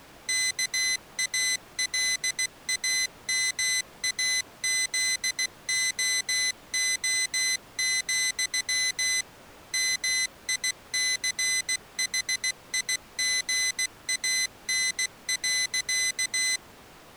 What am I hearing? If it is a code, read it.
Morse code, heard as a high beeper, machine-sent, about 16 wpm, 2000 Hz. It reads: KALAMAZOO, MICHIGAN.